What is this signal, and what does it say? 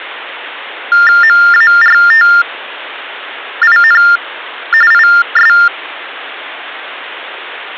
TTY/TDD text telephone tones (45.45 baud Baudot), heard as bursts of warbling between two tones, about 400 Hz shift, 1600 Hz centre. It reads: MARTIN IS